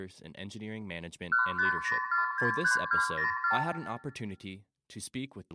Multi-frequency trunk signalling (R2, with the far end's replies), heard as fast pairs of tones, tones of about 130 ms, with room echo and speech in English. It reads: 150463204